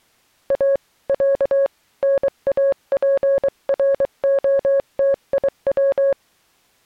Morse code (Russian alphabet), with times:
0.5-0.8 А
1.1-1.7 Я
2.0-6.1 НАПРОТИВ

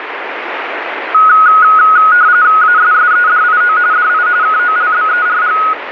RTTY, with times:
2.6-3.8 ASSEDIO
3.9-4.3 DI
4.4-5.6 KOLBERG

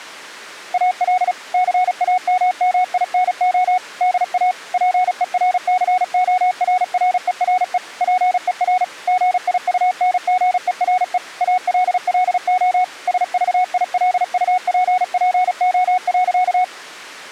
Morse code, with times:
0.7-1.3 AL
1.5-3.8 CAMMINO
4.0-4.5 DA
4.7-7.8 PERCORRERE
8.0-8.8 PER
9.1-11.2 GIUNGERE
11.4-12.8 ALLO
13.1-16.6 SVILUPPO.

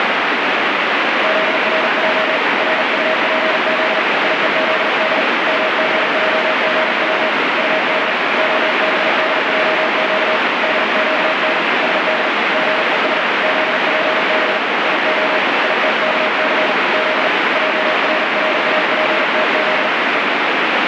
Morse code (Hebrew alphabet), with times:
1.2-2.4 זרע
2.6-4.0 רטפז
4.2-5.2 יוזד
5.5-7.3 מגעגץ
7.6-8.1 טד
8.4-10.4 הבדעק
10.6-11.6 דקן
11.8-12.3 שד
12.5-13.2 גוש
13.4-14.6 זפב
14.9-15.4 יה
15.6-16.7 יתכס
16.9-17.3 ז
17.6-19.9 ערראפתז
20.1-20.2 ו

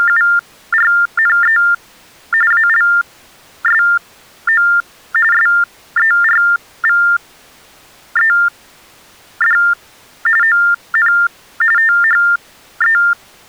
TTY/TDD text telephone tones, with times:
0.0-1.6 …
2.5-4.7 ALSO
5.3-9.6 SERVED
10.4-11.1 ON
11.8-13.0 THE

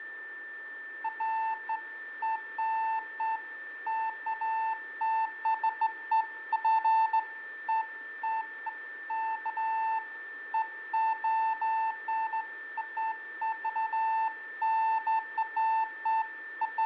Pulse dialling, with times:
none

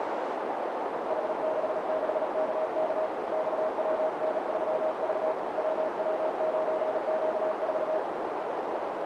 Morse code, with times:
1.1-3.1 H66KK
3.3-5.3 XWN3V
5.6-8.0 WW9Q4

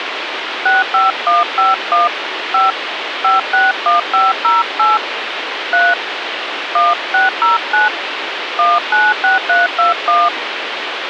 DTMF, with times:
0.7-2.1 65151
2.5-2.7 5
3.2-5.0 561508
5.7-5.9 3
6.8-7.9 1609
8.6-10.3 196321

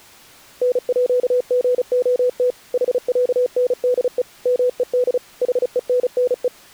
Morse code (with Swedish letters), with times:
0.6-2.5 NÅGOT
2.7-4.2 HÄNDE
4.5-5.2 MED
5.4-6.5 HENNE

